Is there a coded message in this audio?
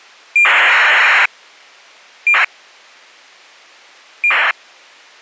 Yes: ACARS aircraft data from 0.4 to 4.5 s, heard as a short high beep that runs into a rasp, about 2400 baud.